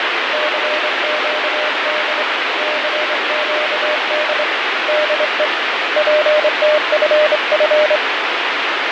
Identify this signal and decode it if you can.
Morse code, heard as a keyed tone, hand-sent with a straight key, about 25 wpm, 610 Hz, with heavy radio static and fading. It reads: CQD CQD DE PTFF